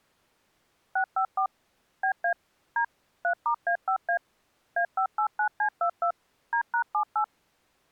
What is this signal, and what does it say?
DTMF, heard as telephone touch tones, dialled by machine, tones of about 90 ms. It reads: 654 BA D 3*A5A A589C22 D#78